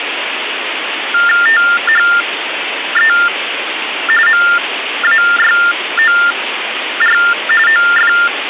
TTY/TDD text telephone tones (45.45 baud Baudot), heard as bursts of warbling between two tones, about 400 Hz shift, 1600 Hz centre, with phone line noise. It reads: THE MAYOR OF